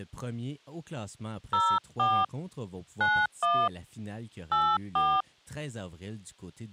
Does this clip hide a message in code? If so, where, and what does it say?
Yes: DTMF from 1.5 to 5.2 s, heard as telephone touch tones, dialled by hand, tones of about 250 ms. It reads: 04 91 84